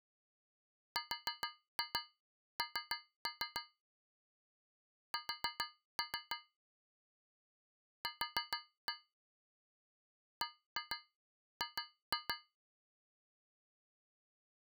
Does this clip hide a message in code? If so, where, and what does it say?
Yes: tap code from 1.0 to 12.6 s, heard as taps on a metal pipe, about 6 knocks a second. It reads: RN S Q BG